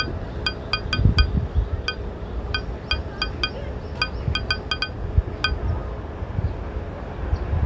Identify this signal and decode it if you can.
Irregular taps on glass, with street noise. There is no code.